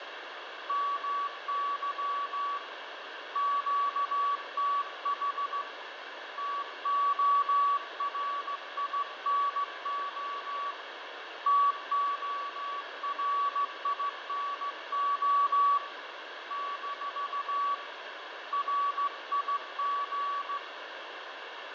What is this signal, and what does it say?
Morse code, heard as a keyed tone, hand-sent with a straight key, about 15 wpm, 1140 Hz, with radio static, fading and room echo. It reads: MY QTH TORINO TORINO - RIG